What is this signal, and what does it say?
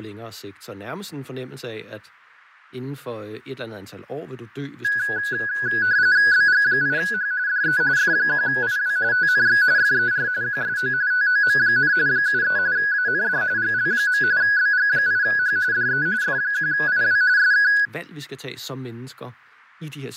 RTTY (45.45 baud, 170 Hz shift), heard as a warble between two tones, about 1550 Hz centre, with fading and speech in Danish. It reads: BG8H DE F1IW TNX FER QSO TOM, 73 AND GL. BG8H DE F1IW SK